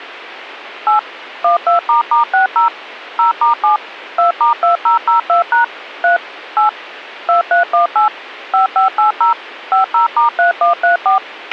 DTMF, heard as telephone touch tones, dialled by machine, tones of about 120 ms, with a squelch burst at the end. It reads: 8 12**60 0*7 2*2002# 3 8 2318 5580 50*3134